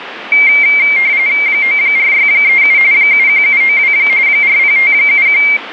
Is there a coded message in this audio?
Yes: RTTY (45.45 baud, 170 Hz shift) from 0.3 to 5.6 s, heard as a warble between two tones, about 2200 Hz centre, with radio static. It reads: 94637 71792 40571